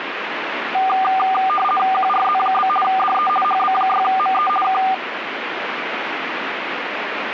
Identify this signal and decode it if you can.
RTTY (50 baud, 450 Hz shift), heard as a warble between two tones, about 980 Hz centre, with radio static. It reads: QRZ? DE HB6ME K